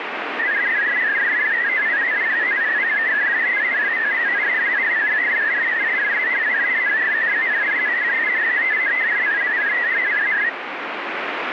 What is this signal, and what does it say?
Multi-tone FSK (Olivia or MFSK type), about 500 Hz wide, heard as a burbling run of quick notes, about 62.5 baud, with radio static.